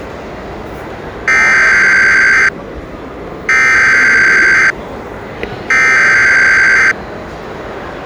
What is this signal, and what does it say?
Emergency Alert System (SAME) tones (header bursts), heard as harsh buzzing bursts, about 520.83 baud, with the noise of a crowd indoors.